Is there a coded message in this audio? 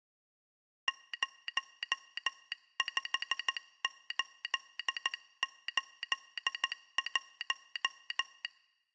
Yes: Morse code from 0.8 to 8.5 s, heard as a telegraph sounder, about 14 wpm. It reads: 05881